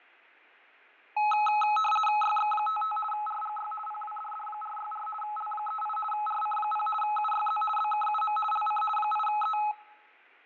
RTTY (50 baud, 450 Hz shift), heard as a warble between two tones, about 1070 Hz centre, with fading. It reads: YX55 RGY PWDD464 L38 RC0 UYZ BKUM LC 8E